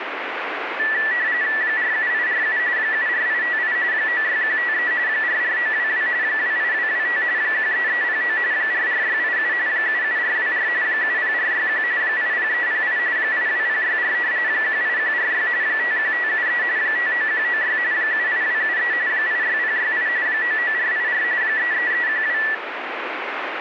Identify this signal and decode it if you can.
RTTY (45.45 baud, 170 Hz shift), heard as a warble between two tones, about 1850 Hz centre, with radio static. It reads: 47847 74858 96153 44922 28225 13309 44687 77424 70461 80308 82064 18146 51573 59196 78273 86068 99484 33312